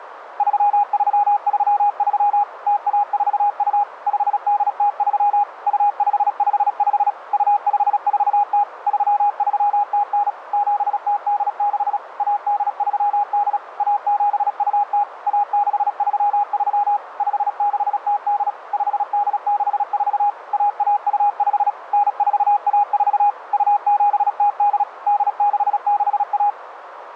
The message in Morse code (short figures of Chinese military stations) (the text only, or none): 3333 0142 5803 2555 2540 3309 7086 1838 1720 1633 5608 5864 1125 9414 2708 8661